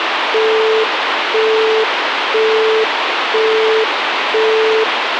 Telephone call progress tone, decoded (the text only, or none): busy tone